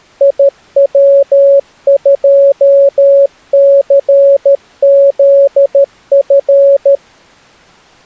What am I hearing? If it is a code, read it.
Morse code, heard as a keyed tone, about 13 wpm, 560 Hz. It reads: IW2CZF